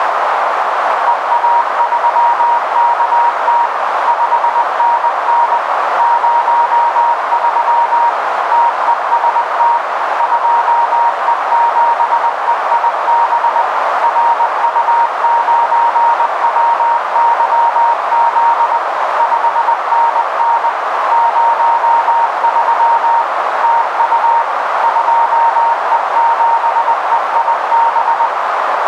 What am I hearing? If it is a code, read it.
Morse code, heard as a keyed tone, machine-sent, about 20 wpm, 940 Hz, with heavy radio static and a narrow filter. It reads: EA3KT 5NN 03 TEST 2E7EIB RU9WYZ 5NN 03 TU 2E7EIB